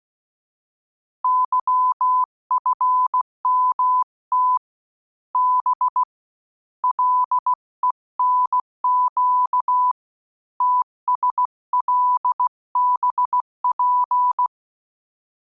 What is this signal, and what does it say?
Morse code, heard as a keyed tone, hand-sent with a bug key, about 16 wpm, 1000 Hz. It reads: YFMT B LENQ TSLBP